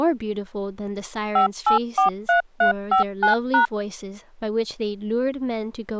DTMF, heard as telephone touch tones, dialled by machine, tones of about 120 ms, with speech in English. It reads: 5843359#